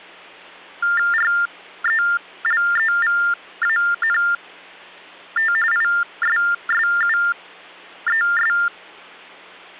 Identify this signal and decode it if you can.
TTY/TDD text telephone tones (45.45 baud Baudot), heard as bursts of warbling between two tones, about 400 Hz shift, 1600 Hz centre, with hum. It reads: RELEVANT ISSUES